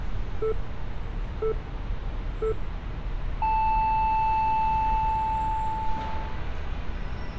Radio time signal (three low pips and a long one an octave up, as on NHK), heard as pips, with street noise.